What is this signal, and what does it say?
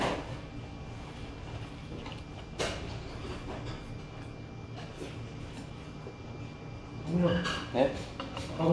The noise of a restaurant. There is no code.